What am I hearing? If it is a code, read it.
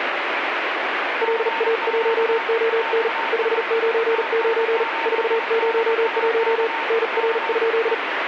Morse code, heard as a keyed tone, hand-sent with a paddle, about 39 wpm, 460 Hz, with radio static and a weaker station near 910 Hz. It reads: LA1ON 599 401 NR?